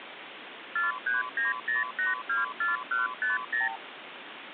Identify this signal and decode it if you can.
Multi-frequency trunk signalling (R2, with the far end's replies), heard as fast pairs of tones, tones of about 150 ms, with phone line noise. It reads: 4390824150